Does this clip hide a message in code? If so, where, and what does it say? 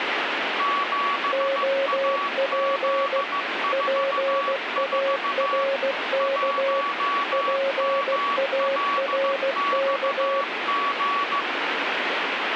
Yes: Morse code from 0.5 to 11.5 s, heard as two keyed tones, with radio static. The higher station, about 15 wpm, 1130 Hz: 7AZ44 1MLXG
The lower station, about 16 wpm, 550 Hz: OP PARK PARK